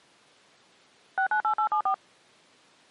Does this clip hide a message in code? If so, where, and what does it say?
Yes: DTMF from 1.2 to 1.9 s, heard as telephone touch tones, dialled by machine, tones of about 90 ms. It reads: 698874